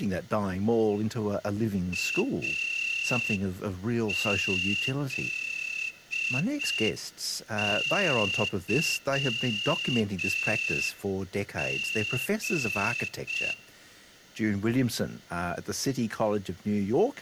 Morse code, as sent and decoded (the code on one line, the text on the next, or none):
.- --.. -.-- --.
AZYG